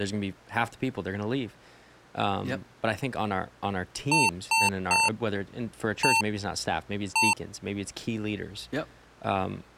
Beep code, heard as beeps from a small speaker, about 900 Hz, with speech in English. 3-1-1. In Phoenix BIOS tables: DMA register failure.